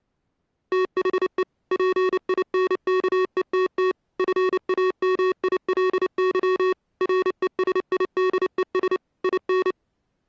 Morse code, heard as electronic beeps, machine-sent, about 29 wpm, 370 Hz. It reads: THE PINKETT FAMILY RESIDES IN